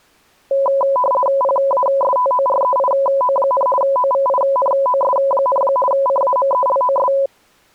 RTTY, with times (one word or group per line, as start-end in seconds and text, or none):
1.4-3.7 PASTOREIO,
3.8-5.6 OVINOS,
5.9-7.1 CAMELOS